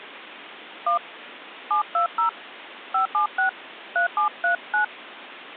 DTMF, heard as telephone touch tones, dialled by hand, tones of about 110 ms. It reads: 1 720 576 3739